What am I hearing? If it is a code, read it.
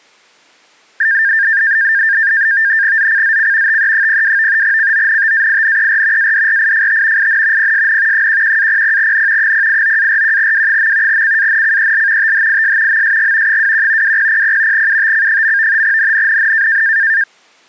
NAVTEX (SITOR-B), 100 baud, 170 Hz shift, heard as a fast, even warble, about 1700 Hz centre. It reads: ZCZC TE02 CONTAINER ADRIFT IN PSN 11-00N 089-41W. CANCEL THIS MSG 21 2000 UTC. NNNN